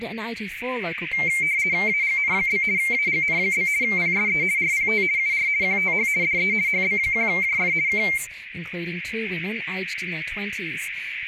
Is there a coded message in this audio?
Yes: RTTY (50 baud, 170 Hz shift) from 1.1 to 8.2 s, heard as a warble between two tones, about 2200 Hz centre, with radio static. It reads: AGN? AGN? PSE RPT UR QTH DE HB1JF K